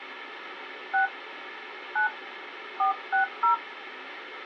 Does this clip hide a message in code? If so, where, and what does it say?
Yes: DTMF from 0.9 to 3.5 s, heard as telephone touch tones, dialled by hand, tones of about 120 ms, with phone line noise. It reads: 6 9 460